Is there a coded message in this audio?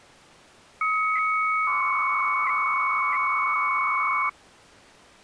Yes: 300-baud modem data (Bell 103 tones) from 0.8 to 4.3 s, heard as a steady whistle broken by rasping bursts, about 300 baud, 200 Hz shift.